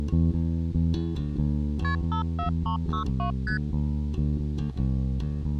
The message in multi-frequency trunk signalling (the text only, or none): KP 54362 ST